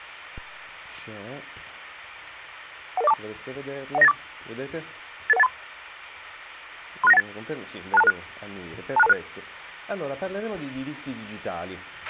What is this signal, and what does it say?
Five-tone selective call (EIA), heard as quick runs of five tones, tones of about 30 ms, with a squelch burst at the end. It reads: 11042 10984 88183 36918 26226 26226